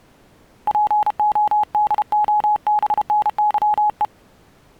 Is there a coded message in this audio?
Yes: Morse code (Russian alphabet) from 0.6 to 4.1 s, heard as a keyed tone, hand-sent with a paddle, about 32 wpm, 840 Hz. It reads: ПОДОБНЫЕ